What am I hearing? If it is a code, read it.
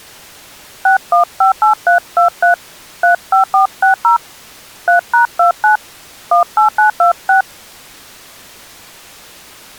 DTMF, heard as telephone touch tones, dialled by hand, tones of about 120 ms. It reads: 6158323 35460 3#29 18926